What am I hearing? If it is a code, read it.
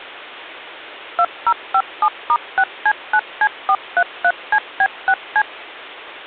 DTMF, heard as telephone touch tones, dialled by machine, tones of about 60 ms. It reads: 2057*6C9C433CB6C